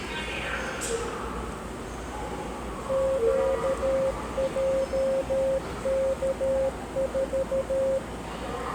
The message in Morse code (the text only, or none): QJK4